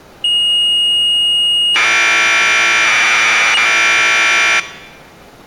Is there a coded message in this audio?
Yes: Commodore tape loading (standard loader) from 0.2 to 4.6 s, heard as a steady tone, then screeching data.